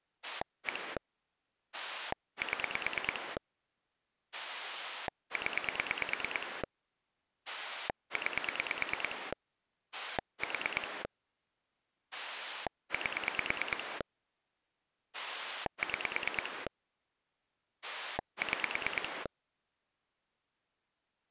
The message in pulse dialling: 1 7 0 9 4 8 6 6

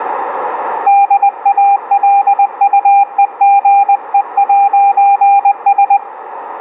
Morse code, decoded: DALUEGE'S

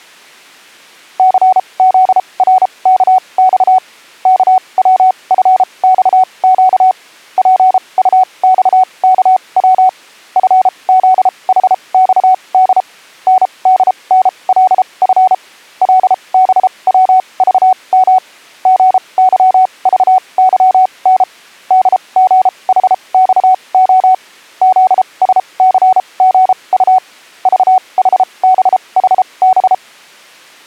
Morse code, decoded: CZRKX KWFXQ PUXKW FZHXD NDNLF LBWVM GYVYN DGHXO ZSCGU VHBHB

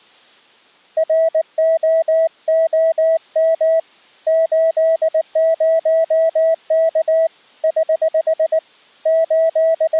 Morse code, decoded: ROOM 80K <HH> …

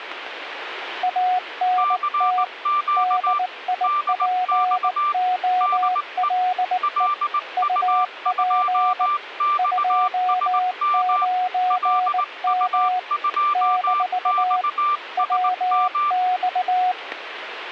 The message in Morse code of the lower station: ANT DIPOLE UP 29M - WX

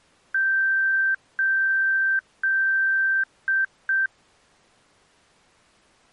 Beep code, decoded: 3 long, 2 short

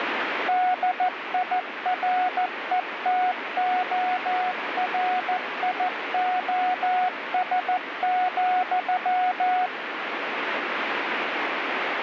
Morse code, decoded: DIRETORIOS,

